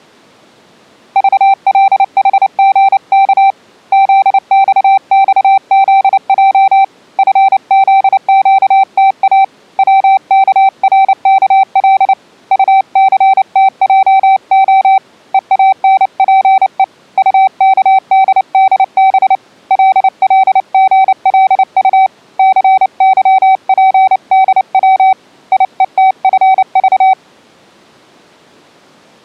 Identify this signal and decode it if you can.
Morse code, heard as a keyed tone, hand-sent with a paddle, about 29 wpm, 770 Hz. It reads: VLHGK ZXXZJ FZQTA WKRKL UCTJO EANPE UKDDB LLGLU CYPDW IETFV